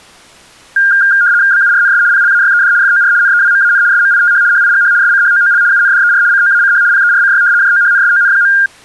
RTTY (75 baud, 170 Hz shift), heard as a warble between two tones, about 1500 Hz centre. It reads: BURNS PLAYED FOR NEWMAN SMITH HIGH SCHOOL UNDER COACH PERCY JOHNSON.